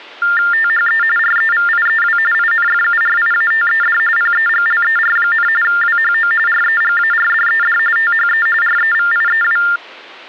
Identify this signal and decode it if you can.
TTY/TDD text telephone tones (45.45 baud Baudot), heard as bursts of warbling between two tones, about 400 Hz shift, 1600 Hz centre. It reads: THE REVIEW INFURIATED PEGLER, WHO REGARDED THE REVIEW